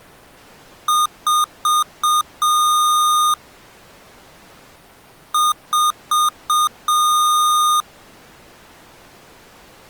Beep code, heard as beeps from a small speaker, played twice, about 1220 Hz. 4 short, 1 long.